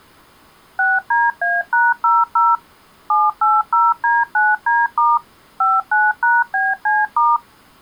DTMF, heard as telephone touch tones, dialled by machine, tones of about 200 ms. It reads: 6DA#00 780D9D* 59#BC*